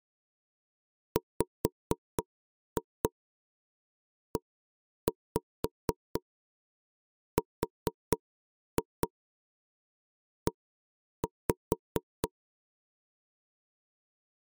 Tap code, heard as knocks on wood, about 4 knocks a second. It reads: WERE